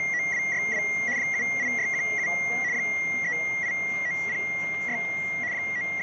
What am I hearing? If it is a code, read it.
RTTY (75 baud, 170 Hz shift), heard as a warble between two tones, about 2050 Hz centre, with static crashes and the noise inside a subway train. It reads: … 78617 38906 …